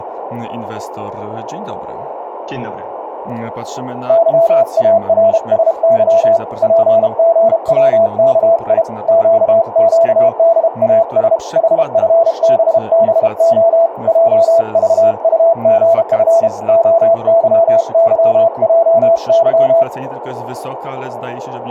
Morse code, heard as a keyed tone, hand-sent with a paddle, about 32 wpm, 670 Hz, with radio static, a narrow filter and speech in Polish. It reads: YARSY PGWKI QQDAS HFBBO JVUGF OYYJY